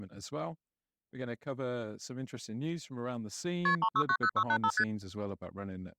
Multi-frequency trunk signalling (R1, as on North American trunks), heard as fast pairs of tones, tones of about 70 ms, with speech in English. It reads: KP 3690685 ST